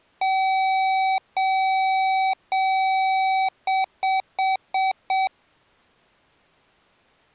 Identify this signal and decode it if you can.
Beep code, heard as beeps from a small speaker, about 760 Hz. 3 long, 5 short.